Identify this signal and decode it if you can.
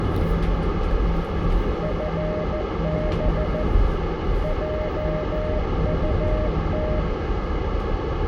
Morse code, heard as a keyed tone, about 14 wpm, 610 Hz, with radio static, a narrow filter, room echo and the noise inside a bus. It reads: FB JUT